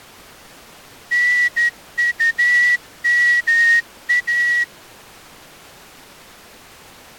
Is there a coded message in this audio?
Yes: Morse code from 1.1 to 4.7 s, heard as a whistle, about 13 wpm. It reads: NUMA